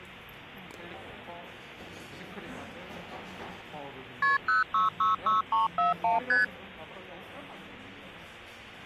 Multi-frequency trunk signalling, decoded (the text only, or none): KP 0666341 ST